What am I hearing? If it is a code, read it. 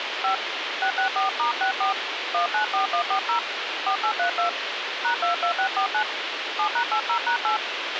DTMF, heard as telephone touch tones, dialled by hand, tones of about 110 ms, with radio hiss and a squelch burst at the end. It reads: 5 664*64 194140 4832 #22649 7#80#8